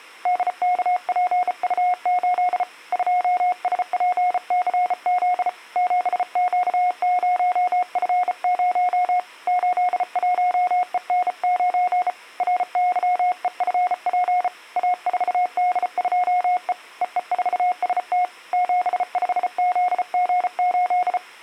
Morse code, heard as a keyed tone, hand-sent with a bug key, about 34 wpm, 720 Hz. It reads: DKPU8 2SPCZ 7Q0F0 81EN9 RYEFP A4D2E EE4ST 75ZG8